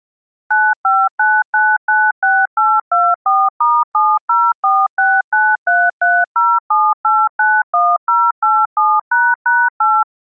DTMF, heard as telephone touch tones, dialled by machine, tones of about 230 ms. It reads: 959996824*704693307891087##8